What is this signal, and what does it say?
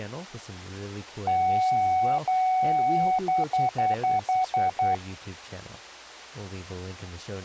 Beep code, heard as beeps, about 750 Hz, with speech in English. 2 long, 7 short.